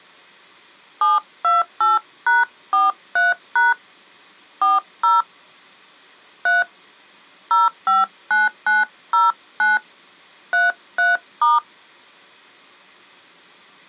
DTMF, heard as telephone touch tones, dialled by hand, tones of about 170 ms. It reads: 728#43# 40 3 059909 33*